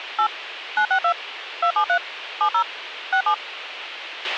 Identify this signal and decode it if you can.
DTMF, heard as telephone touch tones, dialled by machine, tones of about 80 ms, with a squelch burst at the end. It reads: 8 962 273 70 67